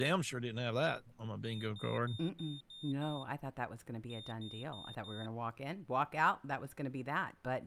Beep code, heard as a piezo beeper, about 3650 Hz, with speech in English. 6-4.